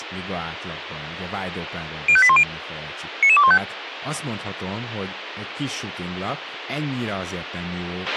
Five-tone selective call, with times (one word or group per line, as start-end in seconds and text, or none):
2.1-2.4 05810
3.2-3.6 99215